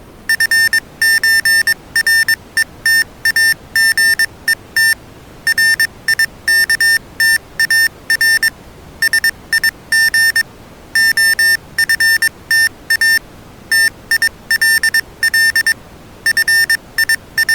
Morse code (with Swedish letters), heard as electronic beeps, machine-sent, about 22 wpm, spaced as for 19 wpm, 1800 Hz. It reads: FÖRETAGET RIKTAR SIG OFTA TILL …